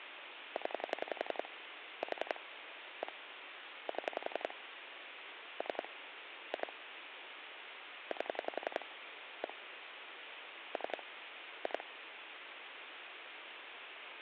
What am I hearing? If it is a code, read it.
Pulse dialling, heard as clicks on a phone line, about 11 pulses a second, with phone line noise. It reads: 0 4 1 7 3 2 8 1 3 2